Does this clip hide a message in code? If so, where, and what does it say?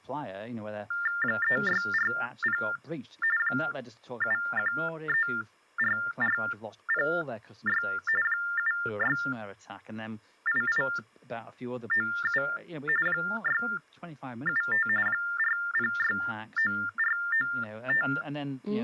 Yes: TTY/TDD text telephone tones (45.45 baud Baudot) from 0.9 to 18.2 s, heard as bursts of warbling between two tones, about 400 Hz shift, 1600 Hz centre. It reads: 3640 7134406 768897 675 4069495